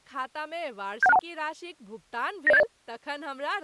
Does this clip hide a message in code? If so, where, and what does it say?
Yes: five-tone selective call (EIA) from 1.0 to 2.6 s, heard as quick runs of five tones, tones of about 30 ms, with speech in Maithili. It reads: 71621 90780